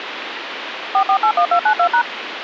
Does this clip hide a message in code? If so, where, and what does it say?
Yes: DTMF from 0.9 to 2.0 s, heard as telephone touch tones, dialled by machine, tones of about 80 ms, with phone line noise. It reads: 4481292#